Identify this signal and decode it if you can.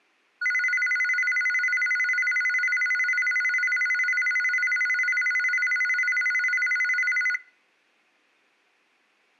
A tone that alternates evenly between two pitches, with room echo. There is no code.